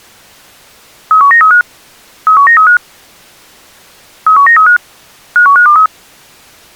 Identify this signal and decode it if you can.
Five-tone selective call (CCIR), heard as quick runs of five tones, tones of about 100 ms. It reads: 31935 31935 31935 51523